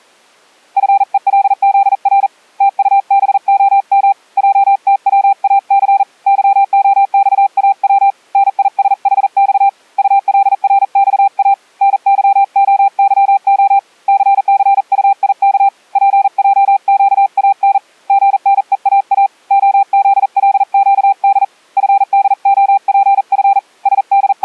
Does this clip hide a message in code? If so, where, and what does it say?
Yes: Morse code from 0.7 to 24.4 s, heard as a keyed tone, hand-sent with a paddle, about 40 wpm, 790 Hz. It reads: FELZR TUBOM JTWAC YOXAW NISHX ULRXA NYOYO CCUIK PJQAN GNEAA OZLQD FDOPF …